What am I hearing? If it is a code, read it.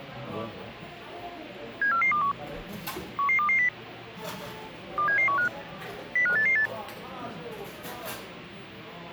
Five-tone selective call (CCIR), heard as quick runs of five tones, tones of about 100 ms, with the noise of a cafe. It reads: 74421 11220 27715 05888